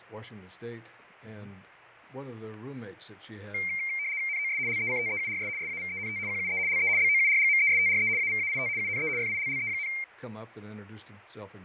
RTTY (75 baud, 170 Hz shift), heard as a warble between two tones, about 2200 Hz centre, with fading. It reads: NOS LECTEURS SAVENT QUE LE BOURGMESTRE AVAIT UNE FILLE,